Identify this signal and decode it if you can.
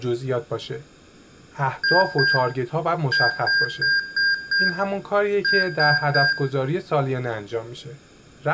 Beep code, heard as beeps from a small speaker, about 1600 Hz, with room echo and speech in Persian. 2-5-3.